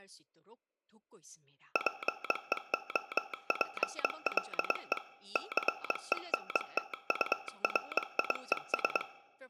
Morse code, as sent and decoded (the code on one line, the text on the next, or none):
.--. . --- .--. .-.. . / -.-. . -. - ..- .-. .. . ...
PEOPLE CENTURIES